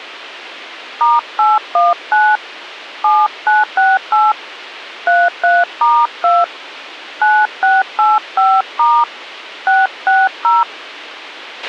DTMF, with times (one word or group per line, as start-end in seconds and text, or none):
1.0-2.4 *819
3.0-4.3 7968
5.1-6.4 33*2
7.2-9.0 9685*
9.7-10.6 660